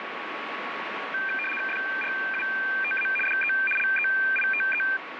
RTTY (75 baud, 850 Hz shift), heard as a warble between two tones, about 2000 Hz centre, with radio static. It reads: FRUTA DE LEITE